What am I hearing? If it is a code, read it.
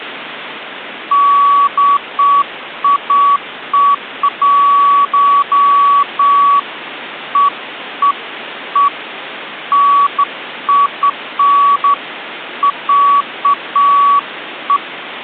Beeps of irregular length, with phone line noise. There is no code.